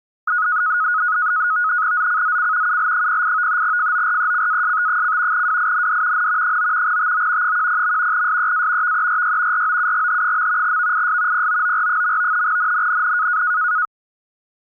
NAVTEX (SITOR-B), 100 baud, 170 Hz shift, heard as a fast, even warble, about 1360 Hz centre. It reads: ZCZC UL08 FORECAST: WIND N 9 TO 10. SEA VERY ROUGH. VIS POOR. NNNN